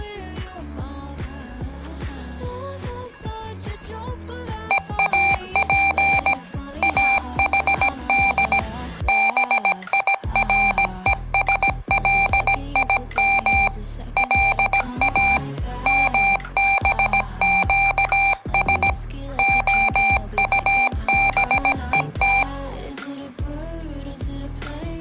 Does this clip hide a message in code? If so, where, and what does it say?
Yes: Morse code (Hebrew alphabet) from 4.6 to 22.5 s, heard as electronic beeps, machine-sent, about 17 wpm, 790 Hz. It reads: ואף אחד בירושלים לא מבקש הטבות